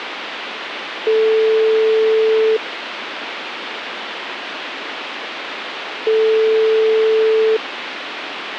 Telephone call progress tone (single-tone plan, as in most of Europe), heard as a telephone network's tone, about 440 Hz, 1.5 s on and 3.5 s off, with phone line noise. Ringback tone.